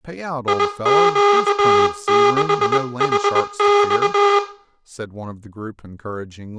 Morse code, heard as a buzzer, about 20 wpm, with room echo and speech in English. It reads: IQ6HX